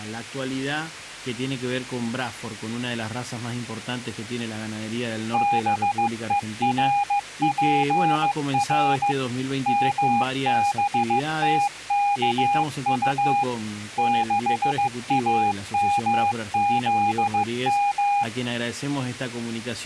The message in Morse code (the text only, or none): BERPR MBTKU 6AMZM